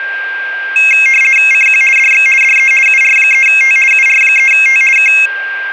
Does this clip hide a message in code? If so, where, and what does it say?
Yes: RTTY (50 baud, 450 Hz shift) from 0.8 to 5.3 s, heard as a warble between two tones, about 2350 Hz centre, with a steady whistle near 1590 Hz. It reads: CQ DX DE UR3T UR3T K